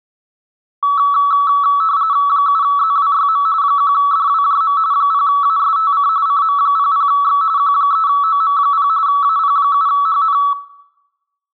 RTTY (45.45 baud, 170 Hz shift), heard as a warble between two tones, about 1220 Hz centre, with room echo. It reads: 7ZWYM 1DWJM 0ASTC CM00X Q3OM0 AP7HN